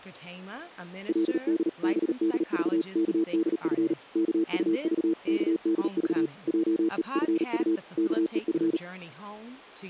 Morse code (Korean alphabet), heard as a keyed tone, machine-sent, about 38 wpm, 330 Hz, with speech in English. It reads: 그들은 일을 하니 안